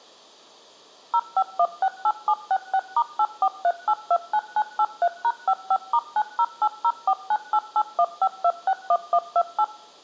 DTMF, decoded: 05168766*843829983#55*9080498815261128

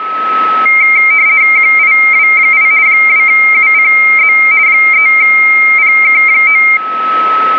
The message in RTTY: QIW8 2UCZ 3PK9

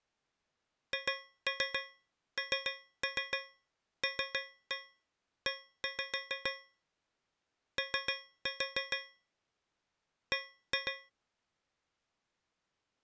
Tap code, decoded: HNLE O B

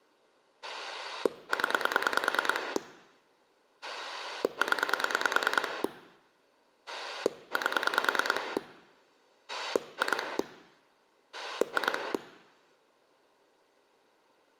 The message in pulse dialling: 0 0 8 2 2

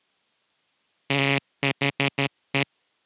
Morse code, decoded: THE

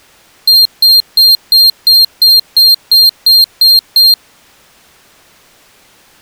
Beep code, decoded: 11 short

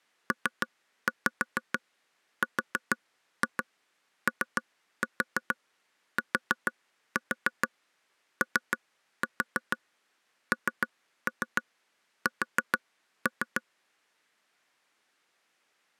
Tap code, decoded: PROTONS

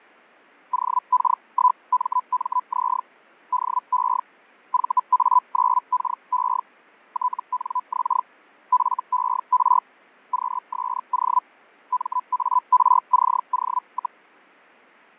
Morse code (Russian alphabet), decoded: none

